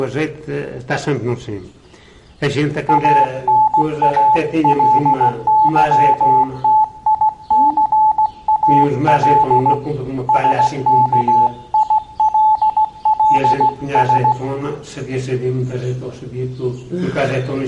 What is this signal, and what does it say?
Morse code, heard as a keyed tone, hand-sent with a straight key, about 16 wpm, 860 Hz. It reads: ANALYTICAL SKILLS